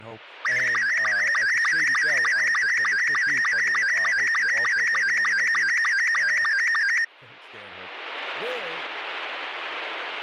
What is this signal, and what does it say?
SSTV (slow-scan television), Robot 72, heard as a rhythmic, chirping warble, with speech in English.